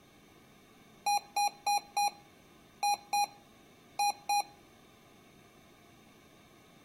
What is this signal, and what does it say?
Beep code, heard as beeps from a small speaker, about 820 Hz. 4-2-2. In Phoenix BIOS tables: shutdown test failure.